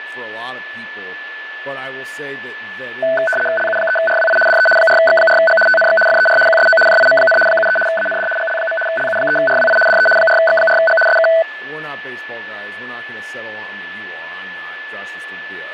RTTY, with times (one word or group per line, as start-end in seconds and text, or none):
3.6-4.4 LU3RWI
4.5-4.7 DE
4.8-5.6 4X4G
5.7-6.0 TNX
6.1-6.4 FER
6.5-6.8 QSO
6.9-7.4 JIM,
7.5-7.8 73
7.9-8.3 AND
8.4-8.8 GL.
8.9-9.8 LU3RWI
9.9-10.1 DE
10.2-11.0 4X4G
11.1-11.3 SK